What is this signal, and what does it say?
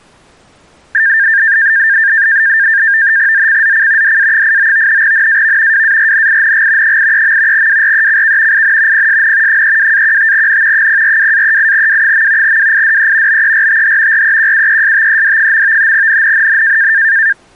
NAVTEX (SITOR-B), 100 baud, 170 Hz shift, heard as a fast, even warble, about 1700 Hz centre. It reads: ZCZC DA89 NAV WARNING 83. WRECK IN PSN 32-15N 042-38W. WIDE BERTH REQUESTED. NNNN